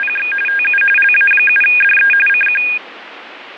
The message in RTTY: … TU LA7DE CQ

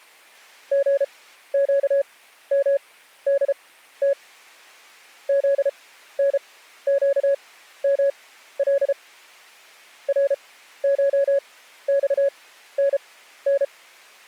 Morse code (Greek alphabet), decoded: ΓΨΜΔΤ ΖΝΨΜΛ ΡΧΞΝΝ

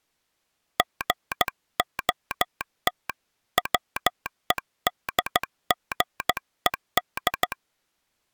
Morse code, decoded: GOT WEDGED

